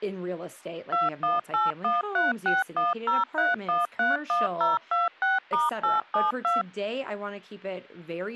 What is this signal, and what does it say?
DTMF, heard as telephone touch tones, dialled by machine, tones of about 170 ms, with speech in English. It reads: 218136103131026*872